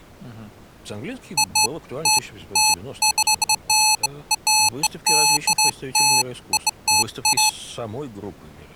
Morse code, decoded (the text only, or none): none